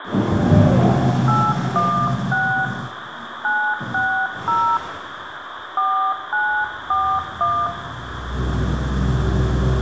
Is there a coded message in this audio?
Yes: DTMF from 1.3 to 7.7 s, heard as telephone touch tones, dialled by hand, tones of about 300 ms, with phone line noise, room echo and the noise inside a lift. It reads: 816 960 4941